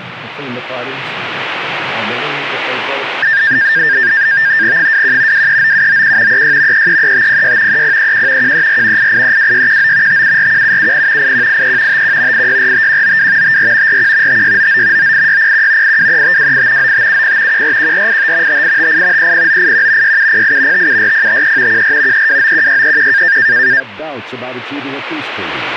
NAVTEX (SITOR-B), 100 baud, 170 Hz shift, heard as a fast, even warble, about 1700 Hz centre, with radio static. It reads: 21 239791 36 333506 3031 134 8832619 5741770 8183 51 8645192 54 41 5699 98601 823528 9570 141485 5858 30981 6708 574053 14 3291631